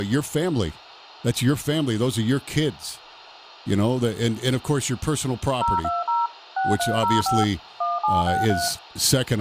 DTMF, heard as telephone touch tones, dialled by machine, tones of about 180 ms, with radio hiss, room echo and speech in English. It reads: 020 6305 1763